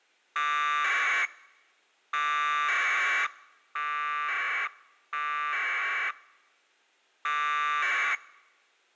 Packet radio (AX.25, as in APRS), 1200 baud, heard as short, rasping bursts.